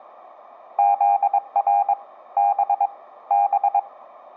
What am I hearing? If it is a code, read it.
Morse code, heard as a keyed tone, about 22 wpm, 800 Hz. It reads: ZR B B